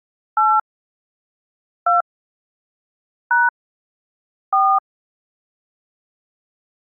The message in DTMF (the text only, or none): 8 2 # 4